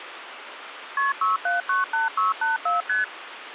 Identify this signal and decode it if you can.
Multi-frequency trunk signalling (R1, as on North American trunks), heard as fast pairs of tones, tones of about 150 ms, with phone line noise. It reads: KP 6798684 ST